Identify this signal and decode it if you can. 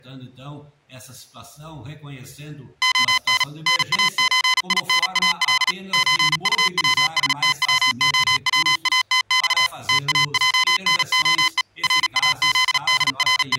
Morse code (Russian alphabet), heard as electronic beeps, machine-sent, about 37 wpm, 1020 Hz. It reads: ОН НАЧИНАЛ ЧУВСТВОВАТЬ ТАЙНОЕ …